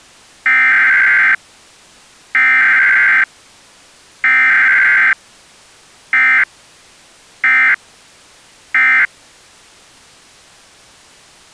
Emergency Alert System (SAME) tones (header bursts, then end-of-message bursts), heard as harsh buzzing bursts, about 520.83 baud.